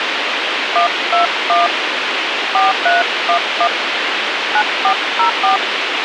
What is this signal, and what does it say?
DTMF, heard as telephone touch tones, dialled by hand, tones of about 120 ms, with radio hiss. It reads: 121 4311 9404